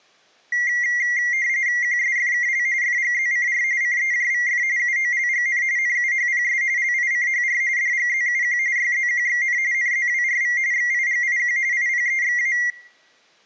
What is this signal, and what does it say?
RTTY (45.45 baud, 170 Hz shift), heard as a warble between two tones, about 2050 Hz centre. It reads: QSFKL FGZCR CEJVF UOLGN NUHPS LICHR DGZUQ YZQXN NZWRV XIGIQ IPEXA